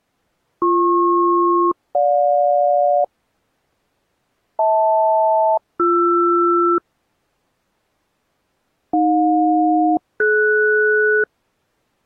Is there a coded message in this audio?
Yes: aircraft SELCAL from 0.6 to 11.2 s, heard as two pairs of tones. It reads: BP-GJ HL-BR AJ-DS